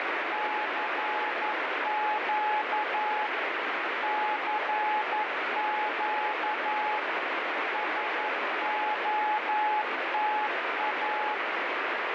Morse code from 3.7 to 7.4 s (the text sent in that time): CQ